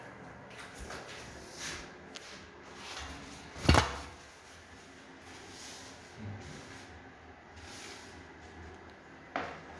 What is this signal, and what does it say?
The noise of a restroom. There is no code.